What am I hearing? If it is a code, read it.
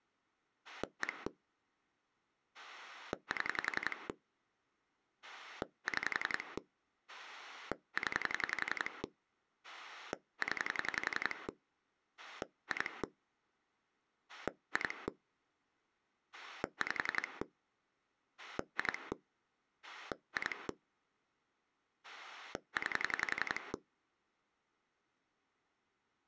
Pulse dialling, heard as a rotary dial, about 11 pulses a second. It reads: 1 7 6 0 0 2 2 5 2 2 9